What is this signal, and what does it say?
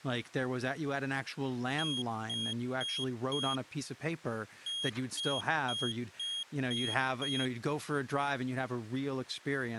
Beep code, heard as a piezo beeper, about 3250 Hz, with speech in English. 4-6.